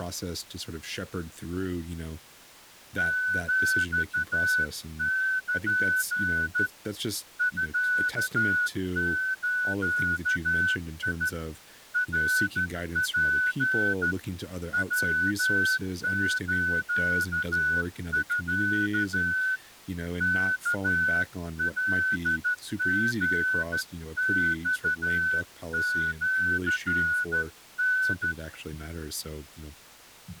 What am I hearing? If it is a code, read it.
Morse code (Japanese Wabun code), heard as a whistle, hand-sent with a straight key, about 13 wpm, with speech in English. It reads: ヒル ミズ ナツ ヤスミ ワカリマシタ